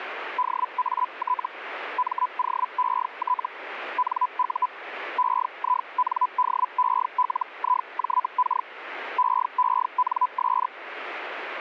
Hellschreiber (Feld-Hell, 122.5 baud), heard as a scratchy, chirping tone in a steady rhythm, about 1000 Hz, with radio static. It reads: DAT MOET NU EINDELIJK EENS